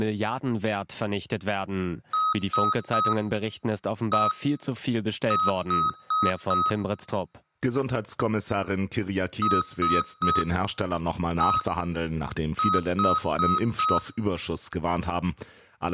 Beep code, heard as beeps from a small speaker, played twice, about 1270 Hz, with speech in German. 3-1-4. In Phoenix BIOS tables: interrupt mask register failure.